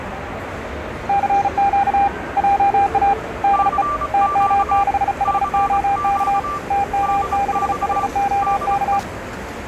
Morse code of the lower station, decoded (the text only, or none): CQ JA DE TM6HOK TM6HOK